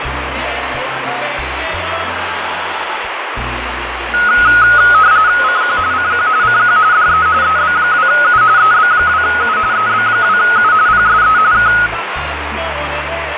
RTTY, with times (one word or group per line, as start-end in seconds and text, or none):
5.4-5.8 CQ
5.9-6.3 CQ
6.4-6.8 CQ
6.9-7.3 DE
7.4-8.4 EB2U
8.6-9.6 EB2U
9.7-10.7 EB2U
10.9-11.4 PSE
11.5-11.7 K